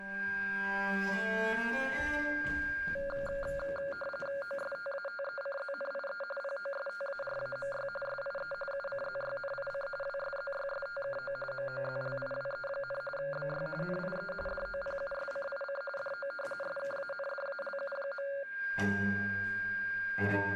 RTTY (45.45 baud, 850 Hz shift), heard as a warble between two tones, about 980 Hz centre, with a steady whistle near 1600 Hz. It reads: OSTATECZNIE POSTARAMY SIE UCZYNIC WSZYSTKO MOZLIWE, BY NIE DOPUSCIC DO SKANDALU.